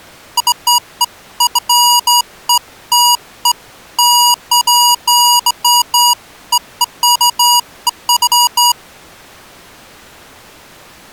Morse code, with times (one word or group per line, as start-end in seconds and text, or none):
none